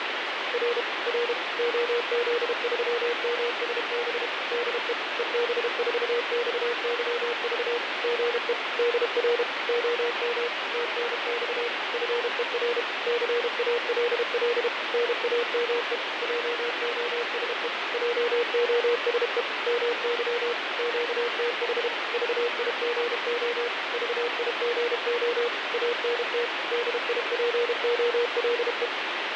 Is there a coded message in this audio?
Yes: Morse code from 0.5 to 28.9 s, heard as a keyed tone, machine-sent, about 32 wpm, 480 Hz, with heavy radio static and fading. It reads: R R OZ3MSB DE EB4XYV GE DR OM TNX FER CALL NAME JOSE JOSE MY QTH VIGO VIGO ANT DIPOLE